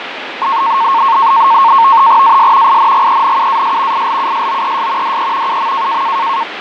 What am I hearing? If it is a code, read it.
NAVTEX (SITOR-B), 100 baud, 170 Hz shift, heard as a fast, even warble, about 1000 Hz centre, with radio static and fading. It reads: AS INGENUAS ILUSOES DE UM